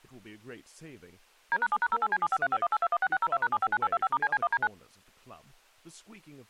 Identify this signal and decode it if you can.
DTMF, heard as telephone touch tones, dialled by machine, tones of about 50 ms, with speech in English. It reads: D#7#08C753518216602#759825*CC1D9